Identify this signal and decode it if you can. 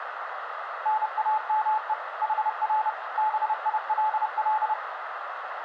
Morse code, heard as a keyed tone, machine-sent, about 30 wpm, 860 Hz, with radio static, a narrow filter and room echo. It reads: NAME HR BILL